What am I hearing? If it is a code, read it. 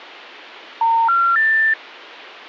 Telephone call progress tone (North American plan), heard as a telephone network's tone, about 910, 1370, 1800 Hz. Special information tone.